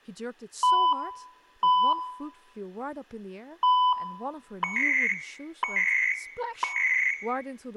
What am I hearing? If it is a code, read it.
Radio time signal (CHU, Canada), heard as beeps and data bursts, one a second, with room echo and speech in English.